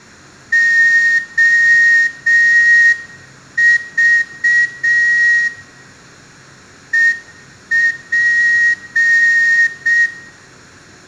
Morse code, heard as a whistle, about 6 wpm, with room echo. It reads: OV EP